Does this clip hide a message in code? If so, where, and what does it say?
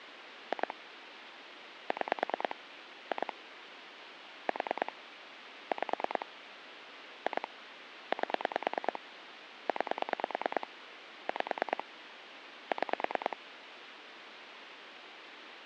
Yes: pulse dialling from 0.5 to 13.3 s, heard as clicks on a phone line, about 9 pulses a second, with phone line noise. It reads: 2 6 2 4 5 2 8 9 5 6